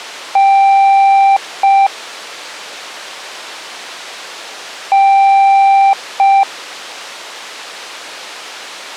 Beep code, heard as beeps, played twice, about 790 Hz. 1 long, 1 short. In IBM BIOS tables: system board problem.